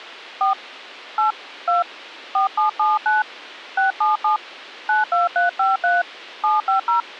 DTMF, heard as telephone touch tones, dialled by hand, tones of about 150 ms. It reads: 4 8 2 4779 677 92353 750